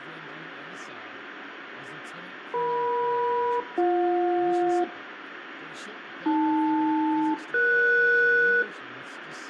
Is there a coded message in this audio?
Yes: aircraft SELCAL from 2.5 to 8.6 s, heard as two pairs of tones, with radio static and room echo. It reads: EM-BJ AL-ES